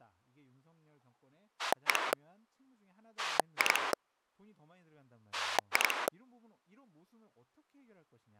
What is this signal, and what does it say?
Pulse dialling, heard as a rotary dial, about 11 pulses a second, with speech in Korean. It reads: 1 2 2